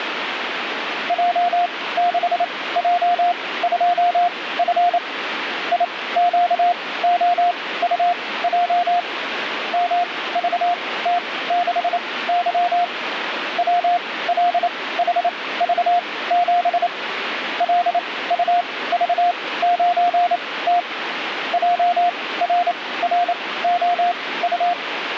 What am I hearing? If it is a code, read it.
Morse code, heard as a keyed tone, machine-sent, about 28 wpm, spaced as for 18 wpm, 700 Hz, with radio static. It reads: J6J2F IQOUJ MVT6Y WLHV7 LUV9T JRROU